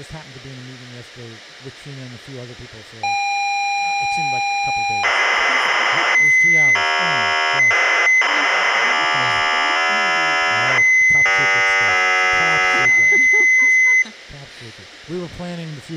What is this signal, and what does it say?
ZX Spectrum tape loading, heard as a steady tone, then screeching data.